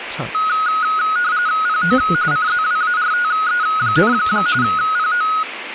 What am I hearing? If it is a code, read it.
RTTY (45.45 baud, 170 Hz shift), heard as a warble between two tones, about 1360 Hz centre, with radio static. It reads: PO CZWARTE, PO